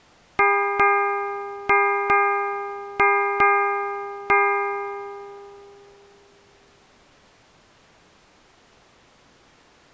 Ship's bell, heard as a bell. 7. Seven half-hours of the watch have passed.